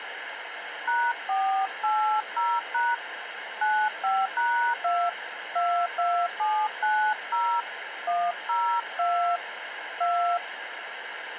DTMF, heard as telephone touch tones, dialled by hand, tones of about 290 ms, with phone line noise. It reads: #480# 95#2 22790 102 2